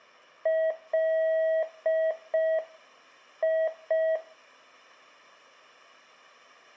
Morse code, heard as a keyed tone, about 5 wpm, 640 Hz. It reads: LI